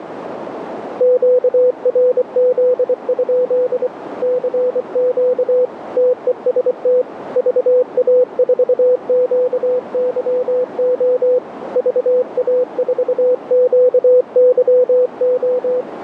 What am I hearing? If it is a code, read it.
Morse code, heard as a keyed tone, hand-sent with a paddle, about 24 wpm, 500 Hz, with radio static and a narrow filter. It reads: QRZ? CQ TEST VA4QYO VA4QYO